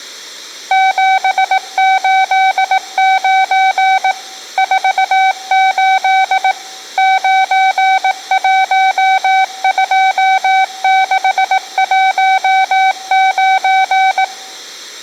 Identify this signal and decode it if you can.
Morse code, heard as a keyed tone, machine-sent, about 18 wpm, 760 Hz, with room echo. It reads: 789 48 912619